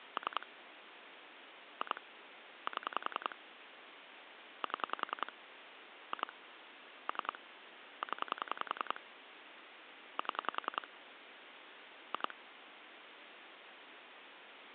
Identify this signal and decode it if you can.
Pulse dialling, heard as clicks on a phone line, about 10 pulses a second, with phone line noise. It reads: 3 2 7 7 2 3 0 7 2